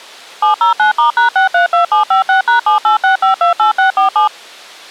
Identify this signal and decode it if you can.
DTMF, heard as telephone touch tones, dialled by machine, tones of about 120 ms. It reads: 709*#632756#786528647